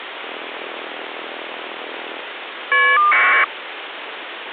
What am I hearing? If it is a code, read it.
Caller ID data burst, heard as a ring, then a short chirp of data, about 1200 baud, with phone line noise.